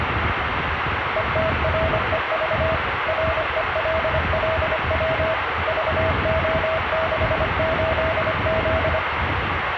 Morse code, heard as a keyed tone, machine-sent, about 25 wpm, 640 Hz, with radio static, room echo and street noise. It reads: ETREV RELLW VO68Z